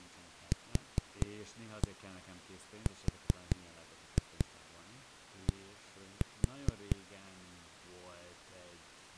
Tap code, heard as knocks on a wall, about 4 knocks a second, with speech in Hungarian. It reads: QRD